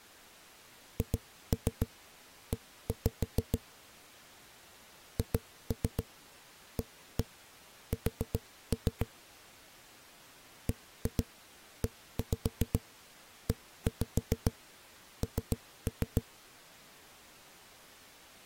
Tap code, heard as knocks on a wall, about 7 knocks a second. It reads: HE HAS BEEN